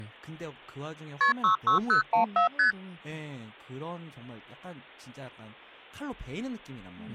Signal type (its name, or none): multi-frequency trunk signalling